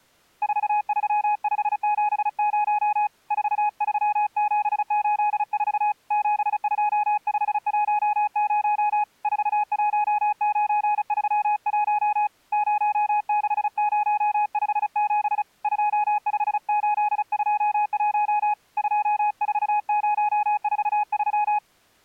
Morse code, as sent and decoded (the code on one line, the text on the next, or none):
....- ...-- ..... --... ----- / ....- ...-- --... ---.. ....- / --... ..--- ..... .---- ----- / ....- .---- ----. ...-- .---- / ----- -.... ----- ..... --... / ..--- ..... ---.. ..--- .---- / ..--- ....- ----- ....- ...--
43570 43784 72510 41931 06057 25821 24043